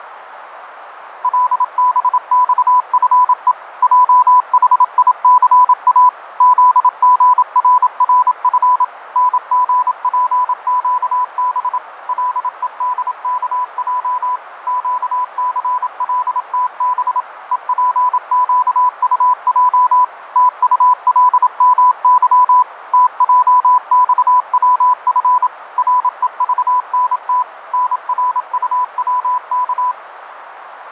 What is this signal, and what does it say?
Morse code, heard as a keyed tone, machine-sent, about 27 wpm, 1000 Hz, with radio static, fading and a narrow filter. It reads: LBXFE JHICA ZGRRF NGPQB LEDKJ QCLTB EPQUJ TULMY TJXWF REVNT NRUWK